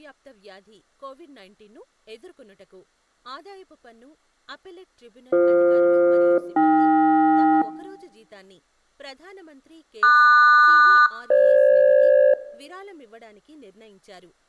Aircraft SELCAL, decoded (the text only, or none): BF-AK QS-FG